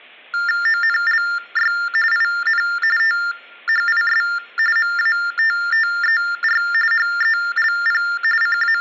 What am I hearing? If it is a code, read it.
TTY/TDD text telephone tones (45.45 baud Baudot), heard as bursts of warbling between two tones, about 400 Hz shift, 1600 Hz centre. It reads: ONLY IN THIS MATTER HELP …